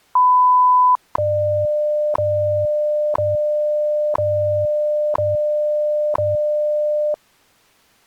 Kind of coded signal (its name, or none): radio time signal